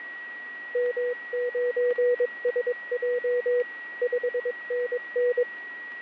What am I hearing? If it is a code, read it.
Morse code, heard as a keyed tone, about 22 wpm, 490 Hz, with a steady whistle near 1920 Hz. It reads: M9SJ 5NN